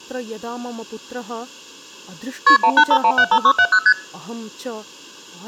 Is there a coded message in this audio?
Yes: multi-frequency trunk signalling (R1, as on North American trunks) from 2.5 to 3.9 s, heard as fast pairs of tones, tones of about 70 ms, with speech in Sanskrit. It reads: KP 185175670 ST